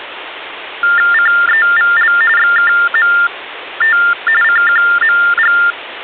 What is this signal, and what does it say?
TTY/TDD text telephone tones (45.45 baud Baudot), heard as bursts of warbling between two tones, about 400 Hz shift, 1600 Hz centre, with phone line noise. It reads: CEVL XKMT CQMG